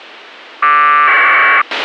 Packet radio (AX.25, as in APRS), 1200 baud, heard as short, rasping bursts, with a squelch burst at the end.